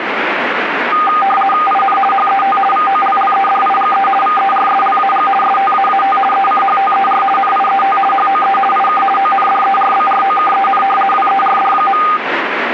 RTTY (50 baud, 450 Hz shift), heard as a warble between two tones, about 1010 Hz centre, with radio static. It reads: IN HET VOLLEDIGE VERSLAG STAAT ECHTER NIET HOE IK ONDERBROKEN WERD.